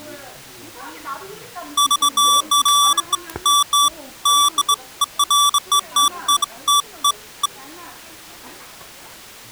Beeps of irregular length, with the noise of a crowd indoors. There is no code.